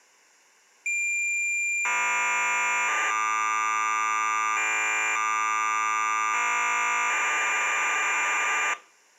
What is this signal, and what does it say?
Cassette data (Kansas City type), 1200 baud, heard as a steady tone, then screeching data.